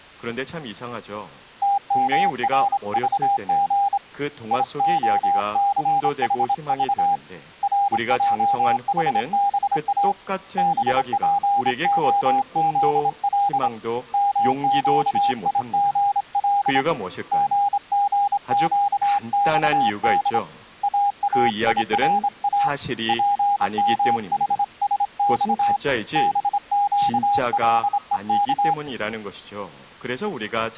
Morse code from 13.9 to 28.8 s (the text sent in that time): MQIGL GGQXD AAIRA PMHSX BQLEK